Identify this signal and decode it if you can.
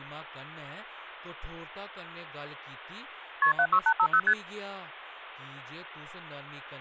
Multi-frequency trunk signalling (R1, as on North American trunks), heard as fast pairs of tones, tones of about 70 ms, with speech in Dogri. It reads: KP 76850 ST